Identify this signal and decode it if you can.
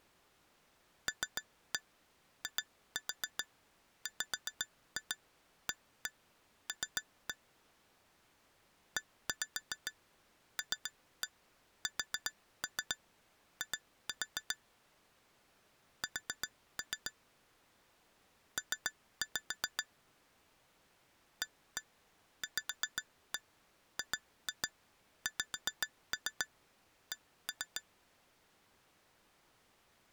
Tap code, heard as taps on glass, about 7 knocks a second. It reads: LIWAL ELSI S P AVGXC